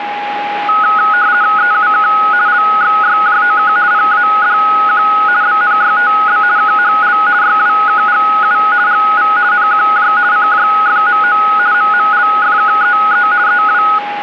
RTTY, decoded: EUK LXYJOK PADQ BNYTB KHL YWKGU GV NQJ CJFMO MMLFKEE EW

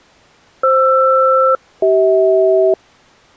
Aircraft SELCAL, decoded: FR-CH

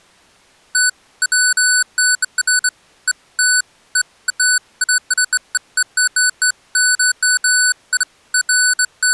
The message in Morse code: none

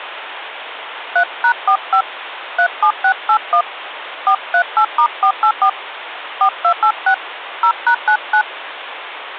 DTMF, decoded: 3#45 37681 438*484 4286 0#99

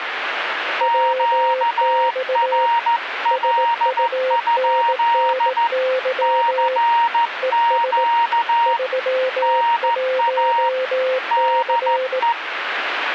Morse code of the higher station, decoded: QRL? CQ NA DE

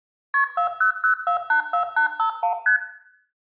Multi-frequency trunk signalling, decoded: KP 400484851 ST

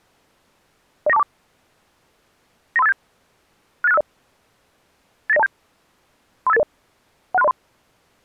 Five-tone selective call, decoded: 09424 93587 68650 89027 35880 16303

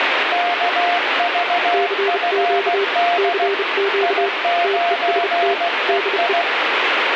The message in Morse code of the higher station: KVFD I9EI

